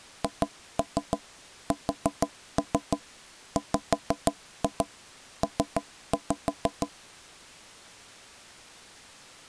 Tap code, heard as knocks on wood, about 6 knocks a second. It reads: HSWP